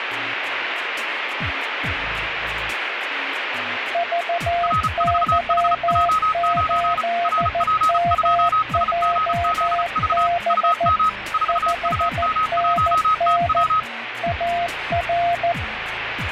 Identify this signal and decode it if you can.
Morse code, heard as two keyed tones, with radio static. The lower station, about 14 wpm, 690 Hz: VY8MJB 5NN AR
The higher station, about 34 wpm, 1270 Hz: R4HJ9 RP2SGZV UM 4UM1TW